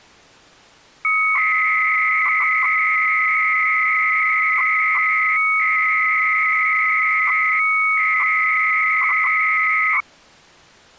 300-baud modem data (Bell 103 tones), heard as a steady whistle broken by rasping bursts, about 300 baud, 200 Hz shift.